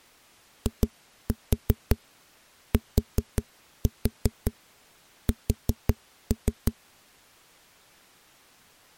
Tap code, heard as knocks on a wall, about 5 knocks a second. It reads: ITS